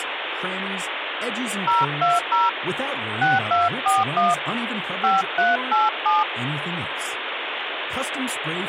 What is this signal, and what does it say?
DTMF, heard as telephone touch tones, dialled by hand, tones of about 180 ms, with phone line noise and speech in English. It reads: 020 6241 5387